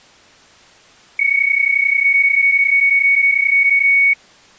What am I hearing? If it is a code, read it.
PSK31 (31.25 baud), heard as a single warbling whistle, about 2250 Hz.